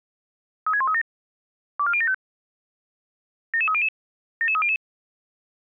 Five-tone selective call (ZVEI), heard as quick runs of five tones, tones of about 70 ms. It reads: 36137 24075 77300 77300